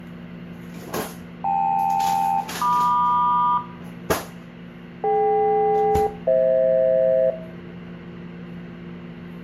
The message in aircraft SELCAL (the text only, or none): KL-MQ DK-FH